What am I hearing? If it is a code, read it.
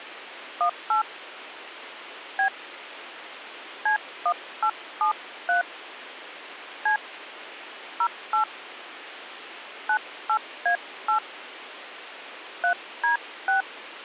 DTMF, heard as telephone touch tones, dialled by hand, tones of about 100 ms, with phone line noise. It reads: 18 B C1873 C 08 98A8 3D6